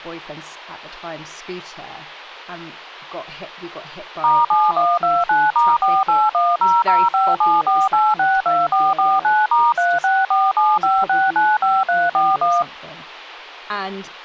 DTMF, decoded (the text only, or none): *7129*48100574862449*36475695341